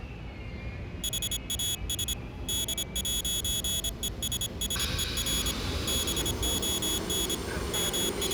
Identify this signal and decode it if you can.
Morse code, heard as a high beeper, hand-sent with a paddle, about 26 wpm, 3350 Hz, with the noise inside a subway train. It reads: HAS D'ESSER BON …